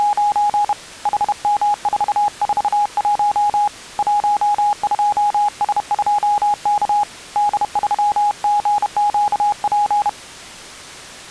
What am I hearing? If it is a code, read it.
Morse code, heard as a keyed tone, hand-sent with a bug key, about 31 wpm, 830 Hz. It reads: … HM441 12S2K D3GQP